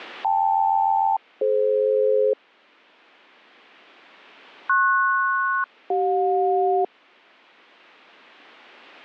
Aircraft SELCAL, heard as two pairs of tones. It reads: KL-DF PS-CJ